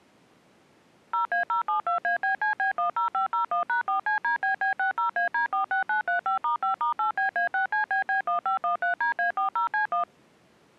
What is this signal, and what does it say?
DTMF, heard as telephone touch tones, dialled by machine, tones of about 120 ms. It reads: 0A072ABCB10501#4CDBB60AD46935*5*8BA6CBB1513DA40C1